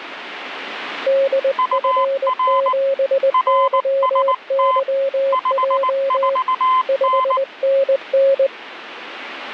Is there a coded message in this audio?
Yes: Morse code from 1.0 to 8.5 s, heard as two keyed tones, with radio static. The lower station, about 20 wpm, 540 Hz: DF7YYJ 5NN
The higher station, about 19 wpm, 1020 Hz: UR RST 54N